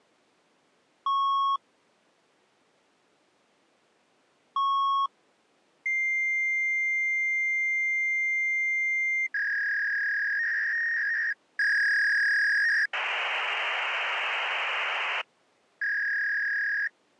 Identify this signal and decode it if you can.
Fax machine handshake, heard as beeps, a long tone, a warble and hiss.